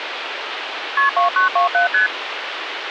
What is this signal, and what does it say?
Multi-frequency trunk signalling (R1, as on North American trunks), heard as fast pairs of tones, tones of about 120 ms, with phone line noise. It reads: KP 2927 ST